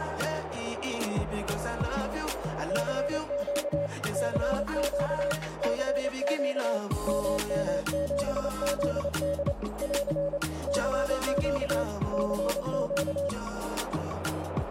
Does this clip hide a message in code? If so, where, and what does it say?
Yes: Morse code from 2.6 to 13.3 s, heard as a keyed tone, machine-sent, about 28 wpm, 570 Hz, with radio static, a narrow filter and room echo. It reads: CQ CQ CQ MM7ZD <AR> CQ CQ